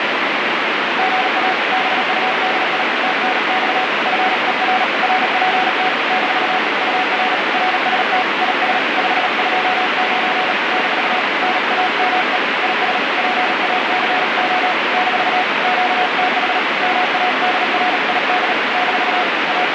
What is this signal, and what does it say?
Morse code, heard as a keyed tone, hand-sent with a paddle, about 37 wpm, 740 Hz, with heavy radio static. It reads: GA BUDI TNX FER RPT - UR RST IS 529 - NAME IS PACO - QTH MADRID - …